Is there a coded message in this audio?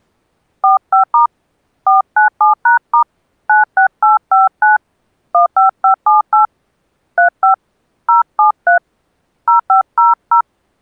Yes: DTMF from 0.6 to 10.4 s, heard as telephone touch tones, dialled by hand, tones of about 130 ms. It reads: 45* 497#* 96859 15578 35 073 0500